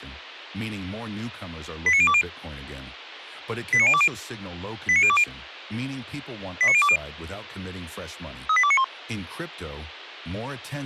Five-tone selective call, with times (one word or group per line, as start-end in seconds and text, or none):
1.9-2.2 89020
3.7-4.1 89020
4.9-5.2 89020
6.6-7.0 89020
8.5-8.8 38291